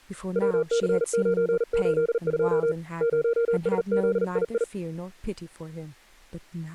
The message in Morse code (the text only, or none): WC982 0SZII